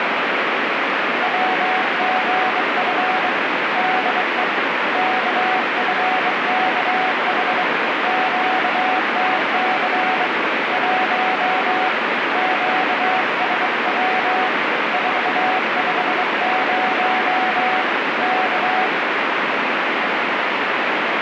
Morse code, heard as a keyed tone, hand-sent with a bug key, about 23 wpm, 750 Hz, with heavy radio static. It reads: WGF DE KFKH QTC 1 QSW 450 K